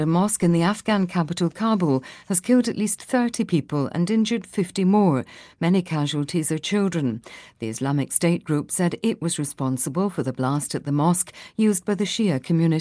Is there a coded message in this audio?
No.